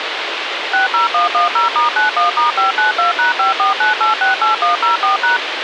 DTMF, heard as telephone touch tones, dialled by machine, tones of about 130 ms, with radio hiss. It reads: 60110*91*592#549868104#